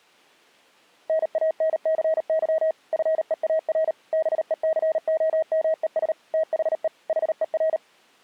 Morse code, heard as a keyed tone, machine-sent, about 38 wpm, 640 Hz. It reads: NANCY FEAR BECOMES THE HER